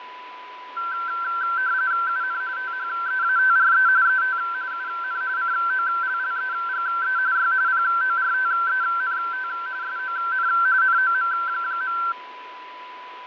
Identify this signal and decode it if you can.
RTTY (45.45 baud, 170 Hz shift), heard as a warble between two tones, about 1450 Hz centre, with radio static, fading and a steady whistle near 1000 Hz. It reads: UN THEATRE ET UN COLLEGE Y PORTENT SON NOM.